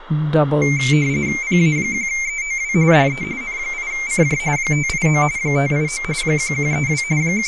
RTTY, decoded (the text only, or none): PA1EOW DE N8CJ 589 589 1132 …